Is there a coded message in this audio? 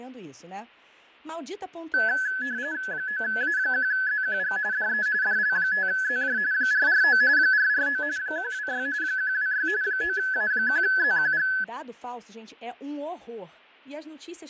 Yes: RTTY (45.45 baud, 170 Hz shift) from 1.9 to 11.6 s, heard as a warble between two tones, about 1600 Hz centre, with fading and speech in Portuguese. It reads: 9A1ZQG DE DL5ZJ 449 449 126 126 9A1ZQG